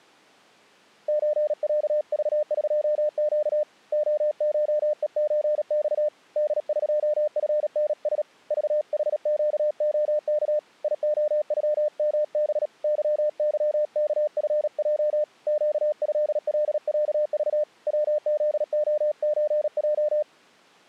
Morse code (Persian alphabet), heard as a keyed tone, hand-sent with a paddle, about 37 wpm, 600 Hz. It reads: چصذقگ عشهچخ دقفنس ذحگعک یعغمب ظظکفج گضلصذ وزعچج